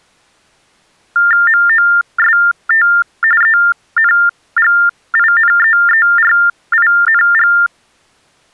TTY/TDD text telephone tones (45.45 baud Baudot), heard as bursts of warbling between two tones, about 400 Hz shift, 1600 Hz centre. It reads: MOST ENGINEERING